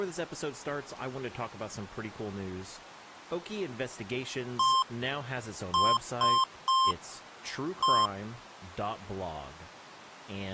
Beep code, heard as beeps from a small speaker, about 1050 Hz, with speech in English. 1-3-1. In Phoenix BIOS tables: memory refresh failure.